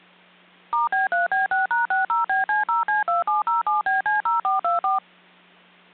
DTMF, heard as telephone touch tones, dialled by machine, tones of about 150 ms. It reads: *B3B6#60BC0C2707BC0424